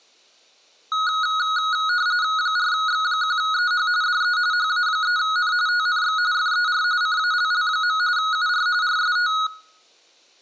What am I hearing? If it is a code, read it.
RTTY (45.45 baud, 170 Hz shift), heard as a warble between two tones, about 1360 Hz centre, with room echo. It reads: 4X1EH DE HA3N TNX FER CALL. UR RST